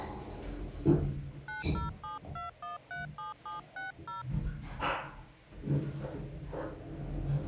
DTMF, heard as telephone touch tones, dialled by hand, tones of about 140 ms, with the noise inside a lift. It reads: 9072137760 2